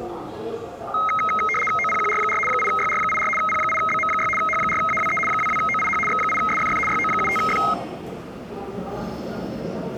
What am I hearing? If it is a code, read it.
RTTY (75 baud, 850 Hz shift), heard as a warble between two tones, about 1700 Hz centre, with the noise of a subway station. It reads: OPQR4 8YR84 P8BM6 H4AWE 22OIH X8SFF YO75F